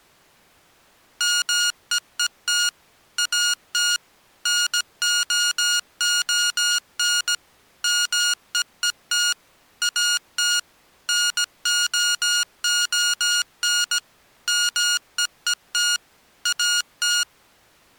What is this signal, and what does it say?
Morse code, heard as electronic beeps, machine-sent, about 17 wpm, 1430 Hz. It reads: MEET AT NOON MEET AT NOON MEET AT